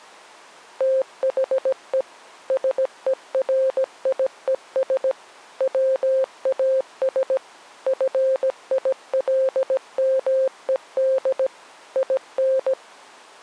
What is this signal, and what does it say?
Morse code, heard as a keyed tone, machine-sent, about 17 wpm, 530 Hz. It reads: THE SERIES WAS FILMED IN